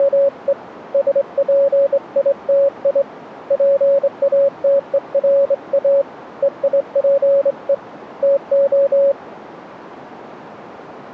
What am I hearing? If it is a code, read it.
Morse code (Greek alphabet), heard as a keyed tone, hand-sent with a straight key, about 24 wpm, 560 Hz. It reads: … ΣΠΙΤΙ ΠΑΤΕΡΑ ΕΙΠΕ ΤΟ